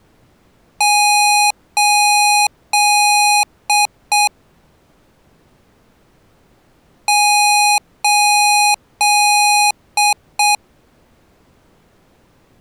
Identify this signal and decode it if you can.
Beep code, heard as beeps from a small speaker, played twice, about 830 Hz. 3 long, 2 short.